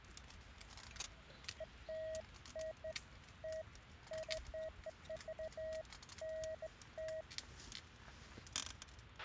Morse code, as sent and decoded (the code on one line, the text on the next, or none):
none